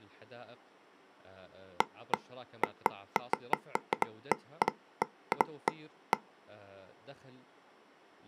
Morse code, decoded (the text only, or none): none